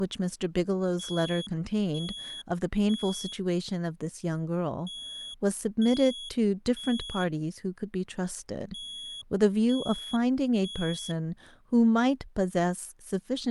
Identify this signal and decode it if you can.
Alarm pattern, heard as an alarm's beeps, played three times, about 3350 Hz, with speech in English. Temporal three. Smoke or fire, evacuate.